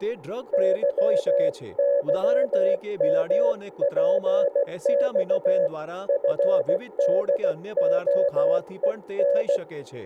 Morse code (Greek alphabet), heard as a keyed tone, hand-sent with a paddle, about 16 wpm, 560 Hz, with speech in Gujarati. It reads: ΥΥΜΠΞ ΦΔΟΕΝ